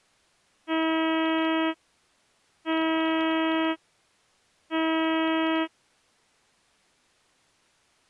Ship horn signal, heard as a ship's horn, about 320 Hz. 3 short. At sea: I am operating astern propulsion.